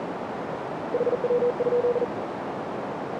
Morse code, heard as a keyed tone, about 40 wpm, 490 Hz, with radio static and a narrow filter. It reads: HW?